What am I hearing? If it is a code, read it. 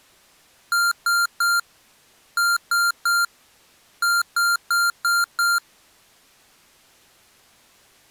Beep code, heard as beeps from a small speaker, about 1390 Hz. 3-3-5.